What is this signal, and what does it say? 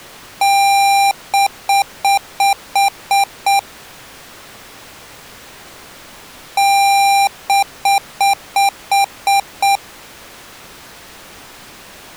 Beep code, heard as beeps from a small speaker, played twice, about 790 Hz. 1 long, 7 short.